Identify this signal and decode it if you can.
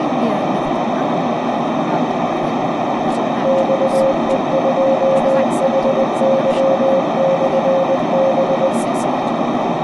Morse code, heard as a keyed tone, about 20 wpm, 540 Hz, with heavy radio static, a narrow filter and speech in English. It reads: XE2HY/B